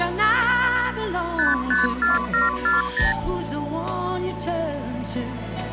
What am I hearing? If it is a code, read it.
Multi-frequency trunk signalling (R2, with the far end's replies), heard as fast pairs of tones, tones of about 160 ms. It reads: 554740